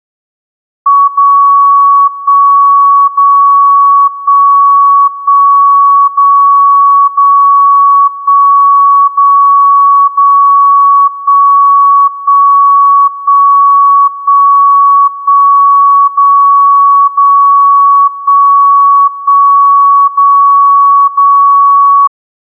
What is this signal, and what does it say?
Radio time signal (DCF77), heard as a tone whose level steps once a second, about 1120 Hz. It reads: 0 1 0 1 1 0 0 1 0 0 1 1 1 1 1 0 0 1 1 0 0